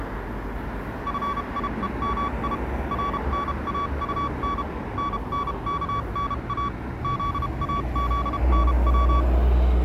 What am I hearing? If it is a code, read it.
Morse code, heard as a keyed tone, machine-sent, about 32 wpm, spaced as for 28 wpm, 1140 Hz, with street noise. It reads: FIEMI RNAUN NNKNA ZAZNW